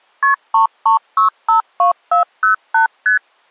Multi-frequency trunk signalling (R1, as on North American trunks), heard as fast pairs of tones, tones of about 120 ms. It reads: KP 33652408 ST